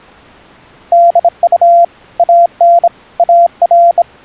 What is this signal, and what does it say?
Morse code, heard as a keyed tone, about 26 wpm, 690 Hz. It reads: DU AN AR